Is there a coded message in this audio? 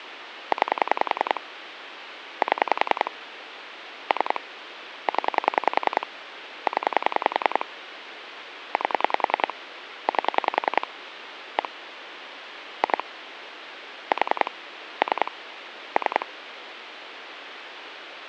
Yes: pulse dialling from 0.5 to 16.2 s, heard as clicks on a phone line, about 10 pulses a second, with phone line noise. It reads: 9 7 3 0 0 8 8 1 2 4 3 3